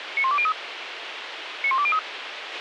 Five-tone selective call (ZVEI), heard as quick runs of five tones, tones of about 70 ms, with radio hiss and a squelch burst at the end. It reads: 91203 91203